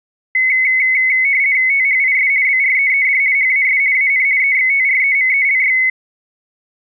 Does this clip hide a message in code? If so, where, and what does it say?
Yes: RTTY (50 baud, 170 Hz shift) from 0.3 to 5.9 s, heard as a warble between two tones, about 2150 Hz centre. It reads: THIS BREED HAS AN EXTREMELY